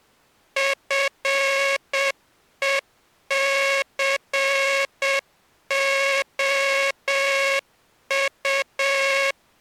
Morse code, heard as a buzzer, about 7 wpm. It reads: FECOU